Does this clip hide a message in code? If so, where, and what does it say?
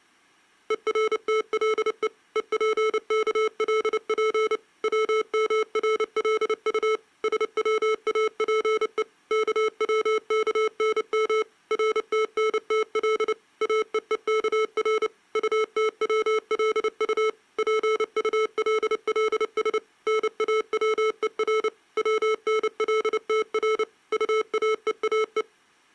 Yes: Morse code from 0.6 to 25.5 s, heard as electronic beeps, machine-sent, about 29 wpm, 440 Hz. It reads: ERTLE EPKLP WMRLU SWAPE KWKNM RTNTL AEEKR UTWLU PULLS NAWER WNLTR UAEAE